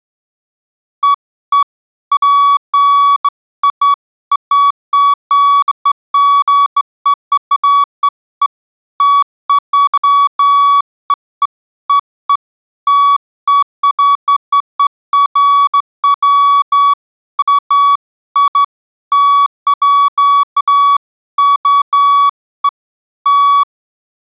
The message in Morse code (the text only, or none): none